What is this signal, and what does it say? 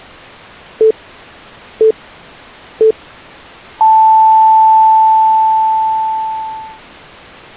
Radio time signal (three low pips and a long one an octave up, as on NHK), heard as pips.